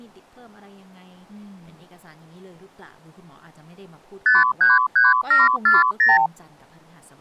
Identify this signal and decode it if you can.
Multi-frequency trunk signalling (R2, with the far end's replies), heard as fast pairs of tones, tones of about 170 ms, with speech in Thai. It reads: 533740